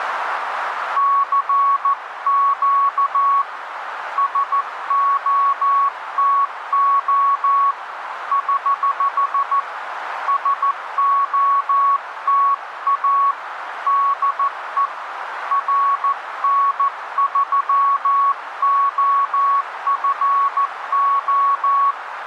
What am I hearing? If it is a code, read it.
Morse code, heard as a keyed tone, hand-sent with a paddle, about 14 wpm, 1120 Hz, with radio static and a narrow filter. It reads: CQ SOTO <HH> SOTA DE RN3OFO